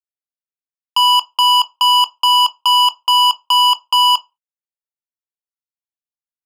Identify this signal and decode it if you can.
Beep code, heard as beeps from a small speaker, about 990 Hz. 8 short. In AMI BIOS tables: display memory failure; in Dell tables: LCD failure.